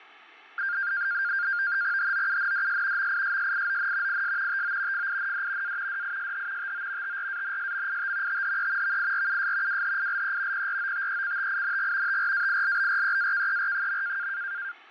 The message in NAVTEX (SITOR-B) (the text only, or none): HOUNDS MISSION IS TO FIND A DISH TO TRANSMIT THE VIRUS WHILE PROTECTING TRAILBREAKER.